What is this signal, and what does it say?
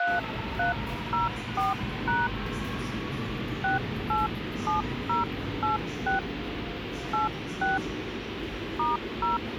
DTMF, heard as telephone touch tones, dialled by hand, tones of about 160 ms, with phone line noise and the noise of a subway station. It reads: 3304# 687086 86 *0